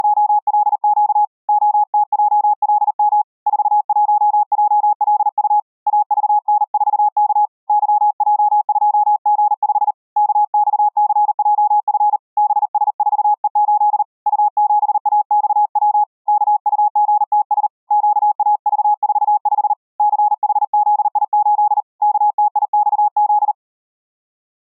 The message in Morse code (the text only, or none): … OTJLM 41JLU AVN4K YJ2G5 KXCJF BS4E8 U7AXW KUGTS QAV45 CHZI8 KTIXZ